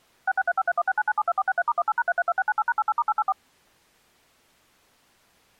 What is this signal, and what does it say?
DTMF, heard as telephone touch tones, dialled by machine, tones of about 40 ms. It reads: 66353169972463*18#332698#88*884